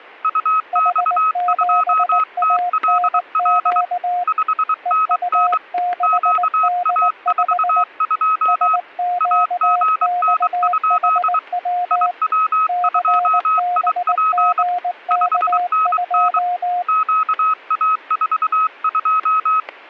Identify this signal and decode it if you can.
Morse code, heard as two keyed tones, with static crashes. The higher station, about 23 wpm, 1280 Hz: UX2TLL 5NN QA42 AGN? IW2IP 5NN QA42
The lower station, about 19 wpm, 710 Hz: H7ANQ EU6D5 SQXHW CBGK2